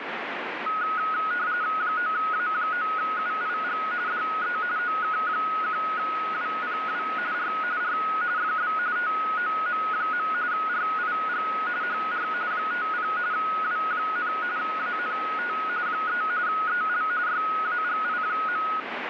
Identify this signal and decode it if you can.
RTTY (45.45 baud, 170 Hz shift), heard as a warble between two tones, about 1360 Hz centre, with radio static. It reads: 9A9UIG DE OK1WPW R R FB TOM. RIG HR 50 W, ANT 3 EL YAGI.